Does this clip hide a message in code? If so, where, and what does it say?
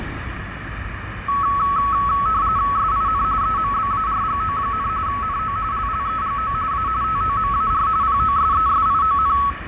Yes: RTTY (45.45 baud, 170 Hz shift) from 1.3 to 9.5 s, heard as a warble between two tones, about 1210 Hz centre, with radio static, fading and street noise. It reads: SIN EMBARGO, NO LLEGO A TOMAR POSESION